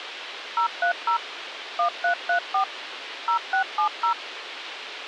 DTMF, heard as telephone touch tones, dialled by machine, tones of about 100 ms, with radio hiss. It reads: 030 1334 0670